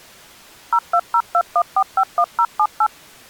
DTMF, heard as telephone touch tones, dialled by machine, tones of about 60 ms. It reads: 02021451078